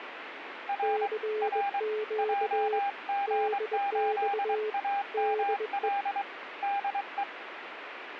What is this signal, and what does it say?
Morse code, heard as two keyed tones, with radio static. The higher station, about 23 wpm, 800 Hz: R R JG8AML DE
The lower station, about 21 wpm, 430 Hz: CQ DX DE